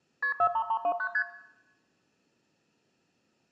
Multi-frequency trunk signalling (R1, as on North American trunks), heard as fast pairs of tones, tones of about 70 ms, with room echo. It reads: KP 43329 ST